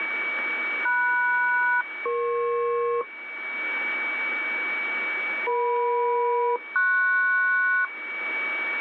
Aircraft SELCAL, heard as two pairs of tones, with radio static and a steady whistle near 2270 Hz. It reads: MS-EP EM-PS